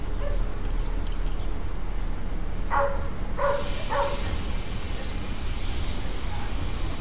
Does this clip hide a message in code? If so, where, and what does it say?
No, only street noise.